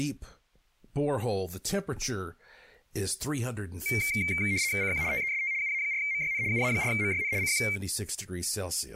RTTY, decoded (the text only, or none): CQ TEST UA4MYN UA4MYN CQ